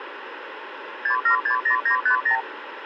Multi-frequency trunk signalling (R2, with the far end's replies), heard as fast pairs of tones, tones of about 100 ms, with phone line noise. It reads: 6760950